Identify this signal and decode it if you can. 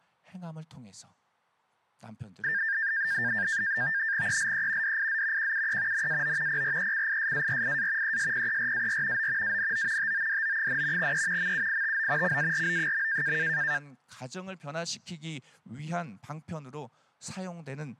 NAVTEX (SITOR-B), 100 baud, 170 Hz shift, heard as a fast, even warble, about 1700 Hz centre, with speech in Korean. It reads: ELE DIZ QUE NAO PRECISARIA ESPERAR O ANO TODO, E MUITO CARO.